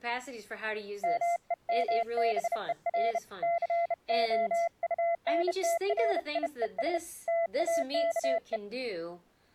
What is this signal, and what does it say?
Morse code, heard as a keyed tone, hand-sent with a bug key, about 31 wpm, 680 Hz, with speech in English. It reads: MEMBER COUNTRIES TAKE